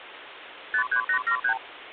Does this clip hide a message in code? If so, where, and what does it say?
Yes: multi-frequency trunk signalling (R2, with the far end's replies) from 0.7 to 1.6 s, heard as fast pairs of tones, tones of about 90 ms, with phone line noise. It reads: 53873